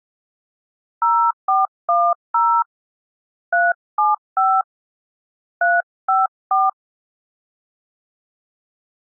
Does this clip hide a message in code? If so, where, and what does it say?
Yes: DTMF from 1.0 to 6.7 s, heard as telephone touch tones, dialled by hand, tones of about 230 ms. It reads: 0410 375 354